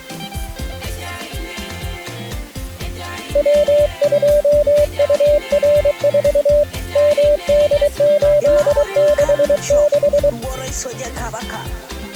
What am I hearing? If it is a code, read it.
Morse code, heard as a keyed tone, hand-sent with a paddle, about 23 wpm, 590 Hz. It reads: W2UR4 MD866